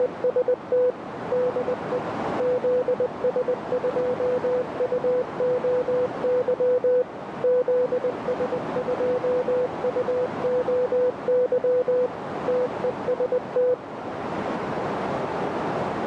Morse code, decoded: … DE ZS2UOY ZS2UOY TEST

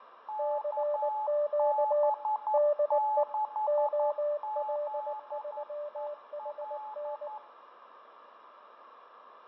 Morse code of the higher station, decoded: KB6ZEL

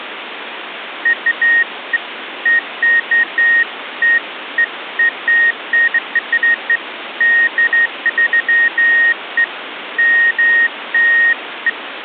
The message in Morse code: none

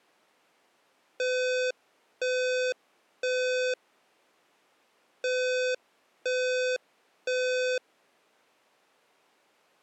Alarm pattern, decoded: temporal three

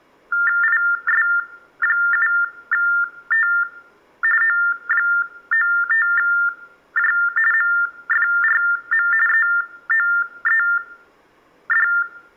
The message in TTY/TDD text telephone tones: IS7T O95J MFRM EOED

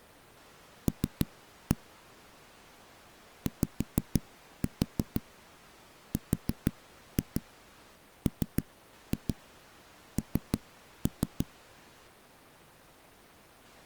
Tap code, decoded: L YRMN

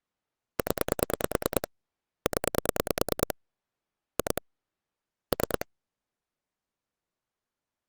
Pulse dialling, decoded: 0 0 2 3

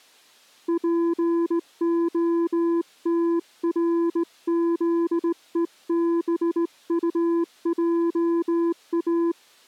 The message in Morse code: POTRZEBUJA

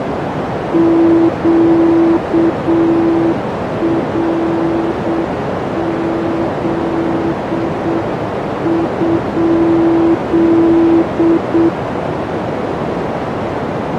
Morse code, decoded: QRZ?

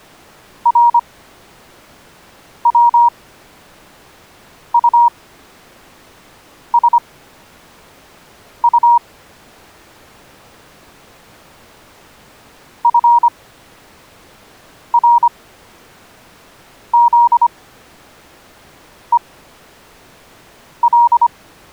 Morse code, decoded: RWUSU FRZEL

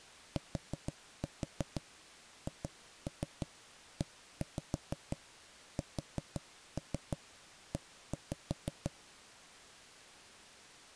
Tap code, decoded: THESE

